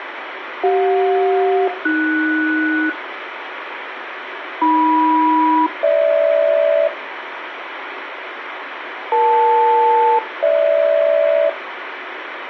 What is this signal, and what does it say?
Aircraft SELCAL, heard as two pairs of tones, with radio hiss. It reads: CJ-AS AM-GH EL-GH